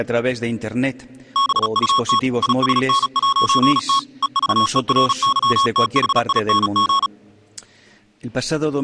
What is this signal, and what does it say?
Morse code, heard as electronic beeps, machine-sent, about 36 wpm, 1100 Hz. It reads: BUT ISN'T EVERYTHING